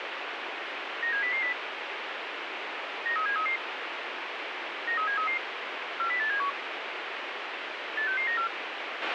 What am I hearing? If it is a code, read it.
Five-tone selective call (CCIR), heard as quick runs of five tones, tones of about 100 ms, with radio hiss and a squelch burst at the end. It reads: 97000 93733 93733 40871 86694